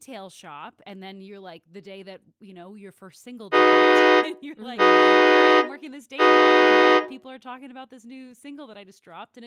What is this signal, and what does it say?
Train horn signal, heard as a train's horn, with speech in English. 3 short. On North American railways: when stopped, the train will back up.